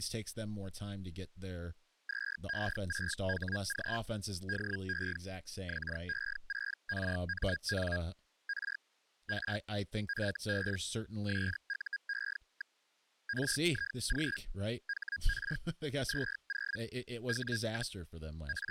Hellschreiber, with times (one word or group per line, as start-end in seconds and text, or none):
2.1-4.0 2E6HG
4.5-5.2 DE
5.7-8.0 XE6RMN
8.5-8.8 R
9.3-9.6 R
10.1-10.8 FB
11.3-12.8 SUE.
13.3-14.4 RIG
14.9-15.6 HR
16.1-16.8 20
17.3-18.0 W,
18.5-18.7 …